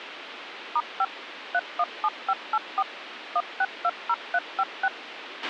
DTMF, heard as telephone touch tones, dialled by machine, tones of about 50 ms, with radio hiss and a squelch burst at the end. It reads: *5 317584 1620356